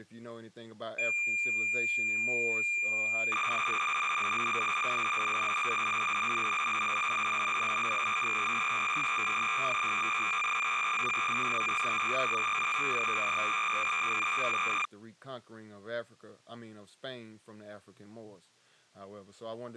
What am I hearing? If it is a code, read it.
Cassette data (Kansas City type), 300 baud, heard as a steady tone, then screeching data, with speech in English.